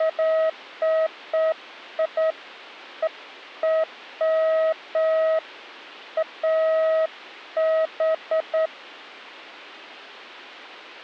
Beeps of irregular length. There is no code.